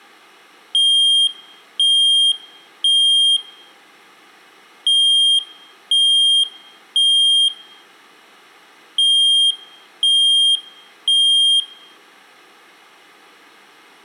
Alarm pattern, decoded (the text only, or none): temporal three